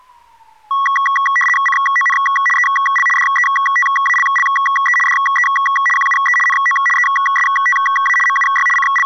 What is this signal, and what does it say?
RTTY (75 baud, 850 Hz shift), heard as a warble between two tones, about 1550 Hz centre, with street noise. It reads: CON EL DETALLE DE QUE NO ESTA MUY …